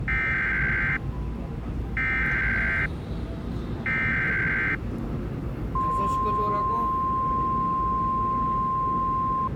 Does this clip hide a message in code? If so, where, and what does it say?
Yes: Emergency Alert System (SAME) tones (header bursts, then the 1050 Hz attention tone) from 0.1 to 9.5 s, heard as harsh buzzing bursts, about 520.83 baud, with the noise inside a subway train.